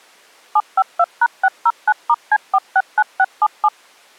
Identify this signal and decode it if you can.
DTMF, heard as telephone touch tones, dialled by machine, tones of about 50 ms. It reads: 752#609*C469677